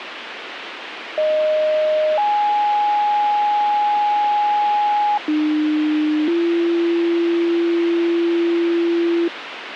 Two-tone page, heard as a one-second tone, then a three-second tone, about 620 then 830 Hz, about 300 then 340 Hz, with radio hiss.